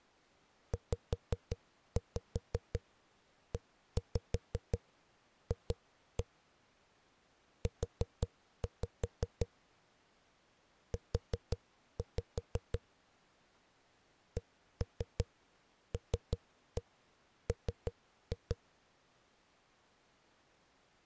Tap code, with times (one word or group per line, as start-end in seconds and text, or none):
0.7-6.2 ZEF
7.7-9.5 U
10.9-12.8 U
14.4-18.6 CLM